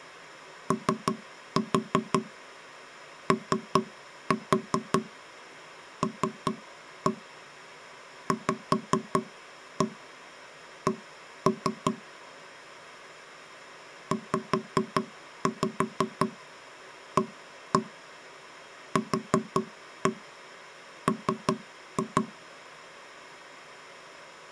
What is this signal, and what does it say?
Tap code, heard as knocks on wood, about 5 knocks a second. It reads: OOLVC ZAQM